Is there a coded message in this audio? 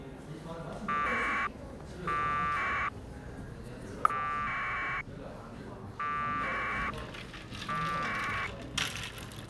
Yes: packet radio (AX.25, as in APRS), 1200 baud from 0.9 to 8.5 s, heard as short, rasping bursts, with the noise of a cafe.